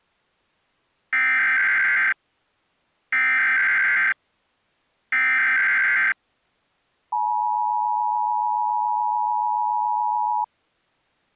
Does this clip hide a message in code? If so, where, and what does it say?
Yes: Emergency Alert System (SAME) tones (header bursts, then the 853 and 960 Hz attention tone) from 1.1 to 10.4 s, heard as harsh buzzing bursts, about 520.83 baud.